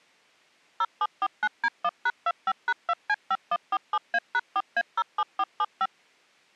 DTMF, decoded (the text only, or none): 0749D1#25#2C5147A#4A07475